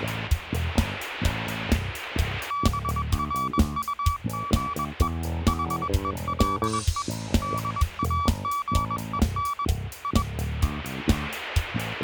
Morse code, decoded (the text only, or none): BRUGE HELE DAGEN I